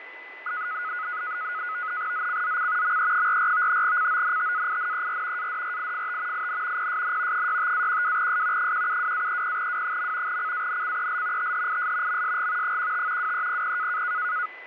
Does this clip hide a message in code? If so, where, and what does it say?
Yes: NAVTEX (SITOR-B), 100 baud, 170 Hz shift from 0.5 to 14.5 s, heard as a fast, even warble, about 1360 Hz centre, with radio static, fading and a steady whistle near 2010 Hz. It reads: ZCZC ME44 CONTAINER ADRIFT IN PSN 65-12S 172-30W. CANCEL THIS MSG 15 2300